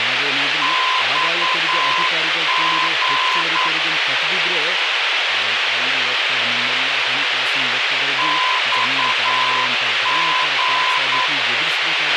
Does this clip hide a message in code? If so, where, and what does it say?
Yes: Morse code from 0.6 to 11.3 s, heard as a keyed tone, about 9 wpm, 1020 Hz, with radio hiss, a squelch burst at the end and speech in Kannada. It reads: XG XG